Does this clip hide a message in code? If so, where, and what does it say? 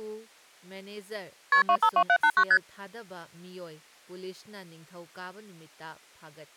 Yes: multi-frequency trunk signalling (R1, as on North American trunks) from 1.5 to 2.6 s, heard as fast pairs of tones, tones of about 70 ms, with speech in Manipuri. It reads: KP 252789 ST